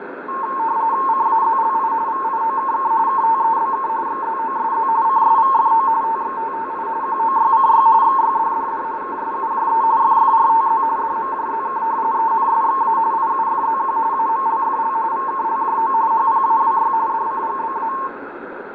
RTTY (45.45 baud, 170 Hz shift), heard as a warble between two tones, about 990 Hz centre, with radio static, fading, a steady whistle near 2040 Hz and room echo. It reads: CAZLI VIOKK KTEBK XZOSZ CSVFO TXTTI QOYCY XYDDD KSUJE FFRTZ DMJZK ENSXA IUFZQ AMLFL VKLJO HPAWY DCGBA